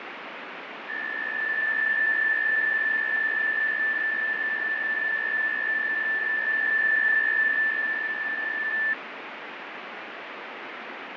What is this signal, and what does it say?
PSK63 (62.5 baud), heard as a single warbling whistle, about 1750 Hz, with radio static and fading.